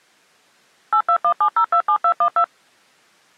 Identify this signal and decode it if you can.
DTMF, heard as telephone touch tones, dialled by machine, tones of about 80 ms. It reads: 8217027212